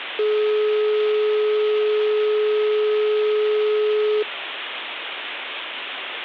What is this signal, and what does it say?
Telephone call progress tone (425 Hz plan, as in most of Europe), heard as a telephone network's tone, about 420 Hz, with phone line noise. Dial tone.